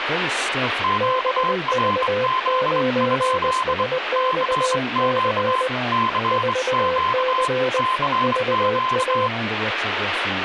Morse code, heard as two keyed tones, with radio static and speech in English. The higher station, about 24 wpm, 1040 Hz: QRZ? CQ CQ CQ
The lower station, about 20 wpm, 510 Hz: BV9SXC 4C VA